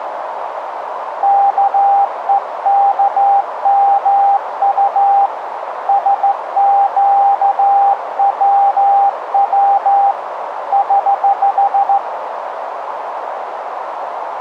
Morse code, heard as a keyed tone, hand-sent with a straight key, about 14 wpm, 800 Hz, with radio static and a narrow filter. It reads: KEKMU SQWW <HH>